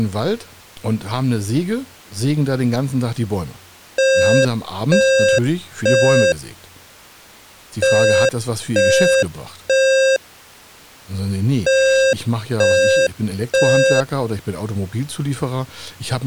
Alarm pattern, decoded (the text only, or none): temporal three